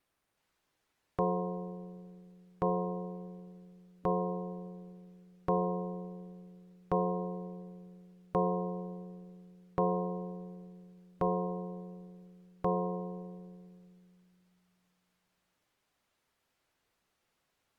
Clock strike, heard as a bell. 9. Nine o'clock.